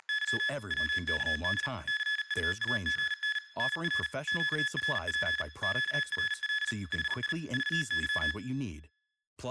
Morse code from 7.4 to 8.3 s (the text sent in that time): VY